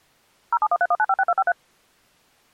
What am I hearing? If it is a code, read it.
DTMF, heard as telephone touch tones, dialled by machine, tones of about 50 ms. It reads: 07131956253